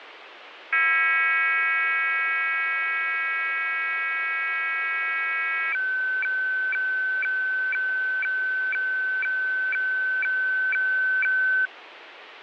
Weather fax (radiofax), 120 lines a minute, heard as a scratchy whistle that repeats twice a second, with radio static.